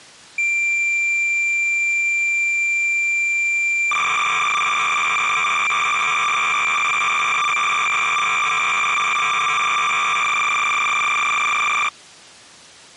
Cassette data (Kansas City type), 300 baud, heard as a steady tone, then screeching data.